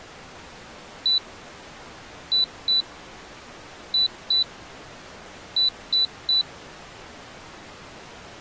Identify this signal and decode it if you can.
Beep code, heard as a piezo beeper, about 3950 Hz. 1-2-2-3. In Phoenix BIOS tables: BIOS ROM checksum failure.